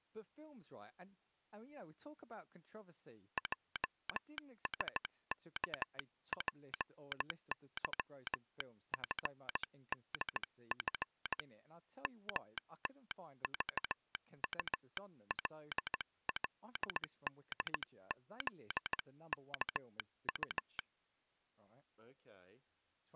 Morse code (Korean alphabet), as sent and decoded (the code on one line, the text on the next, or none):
.--- ... -.- .--. -.-- ..-. -.. ..-. / -- - ...- ..- .-.. .-.. -.. --.. -.- ..-
형제는 머리끝이